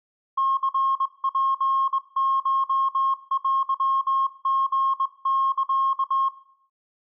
Morse code (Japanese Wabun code), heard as a keyed tone, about 21 wpm, 1080 Hz. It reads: ニツコテリサ